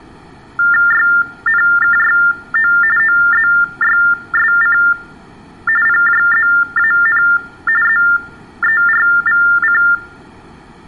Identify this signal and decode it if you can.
TTY/TDD text telephone tones (45.45 baud Baudot), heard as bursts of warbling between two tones, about 400 Hz shift, 1600 Hz centre. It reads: YNKYO OZYSC PJZAN ZERVC